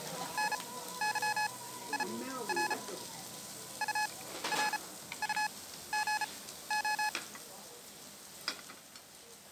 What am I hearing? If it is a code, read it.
Morse code, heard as electronic beeps, machine-sent, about 34 wpm, spaced as for 15 wpm, 850 Hz, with the noise of a restaurant. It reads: NYIR URUGO